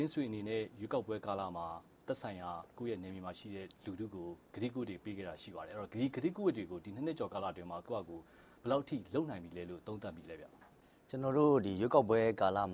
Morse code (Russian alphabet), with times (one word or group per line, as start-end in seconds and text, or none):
none